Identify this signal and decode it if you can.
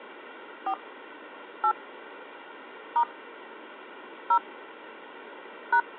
DTMF, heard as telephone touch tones, dialled by hand, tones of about 70 ms. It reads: 4 8 * 0 #